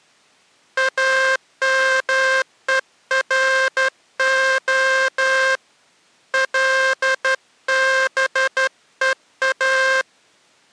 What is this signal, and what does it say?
Morse code (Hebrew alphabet), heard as a buzzer, hand-sent with a straight key, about 12 wpm. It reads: אמורה לבוא